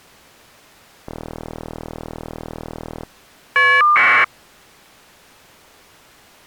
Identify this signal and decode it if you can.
Caller ID data burst, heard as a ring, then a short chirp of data, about 1200 baud.